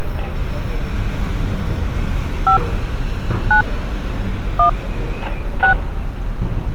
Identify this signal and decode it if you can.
DTMF, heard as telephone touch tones, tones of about 100 ms, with street noise. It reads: 5 9 1 6